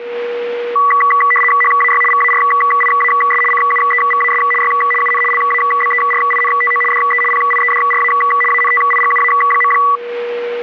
RTTY (75 baud, 850 Hz shift), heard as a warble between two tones, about 1550 Hz centre, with radio static and a steady whistle near 480 Hz. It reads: HAY VARIAS CUEVAS Y UN LABERINTO DE PIEDRA ANTIGUA.